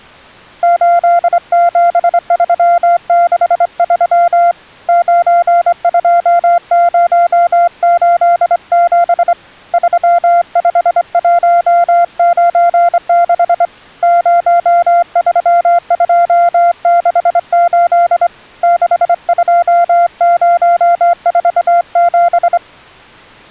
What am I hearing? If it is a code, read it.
Morse code, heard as a keyed tone, hand-sent with a straight key, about 25 wpm, 690 Hz. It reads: 87363 92087 35196 03268 62047